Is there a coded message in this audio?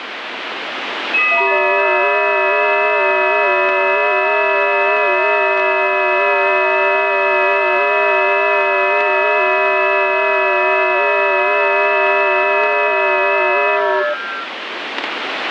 Yes: FT8 (several signals at once) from 1.1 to 14.5 s, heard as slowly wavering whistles, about 6.25 baud, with radio static.